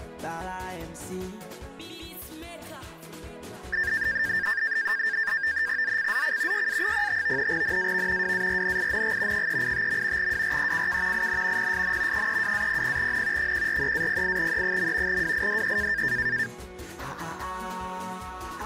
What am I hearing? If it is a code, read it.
NAVTEX (SITOR-B), 100 baud, 170 Hz shift, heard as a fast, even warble, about 1700 Hz centre. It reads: ZCZC YA05 NAV WARNING 385. WRECK IN PSN 32-00N 143-08E. WIDE